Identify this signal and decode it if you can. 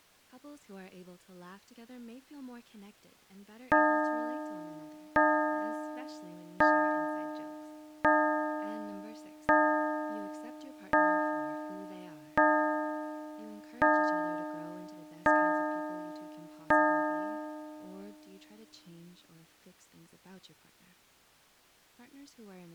Clock strike, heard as a bell, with speech in English. 10. Ten o'clock.